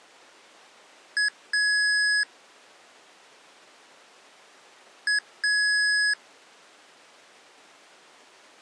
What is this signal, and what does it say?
Beep code, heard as beeps from a small speaker, played twice, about 1700 Hz. 1 short, 1 long.